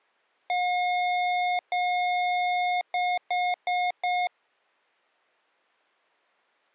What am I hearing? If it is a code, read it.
Beep code, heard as beeps from a small speaker, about 720 Hz. 2 long, 4 short.